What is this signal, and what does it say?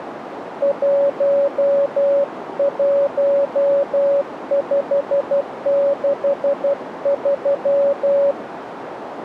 Morse code, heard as a keyed tone, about 12 wpm, 560 Hz, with radio static and a narrow filter. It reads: 11563